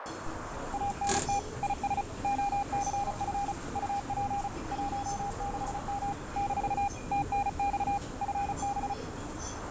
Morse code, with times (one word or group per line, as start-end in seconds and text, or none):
0.7-1.4 ANT
1.6-2.0 IS
2.2-3.5 OCF
3.8-4.5 UP
4.7-6.1 16M
6.4-6.9 -
7.1-8.0 TNX
8.2-8.9 FB